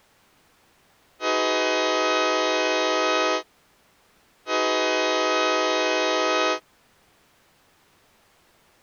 Train horn signal, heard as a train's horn. 2 long. On North American railways: brakes released, proceed.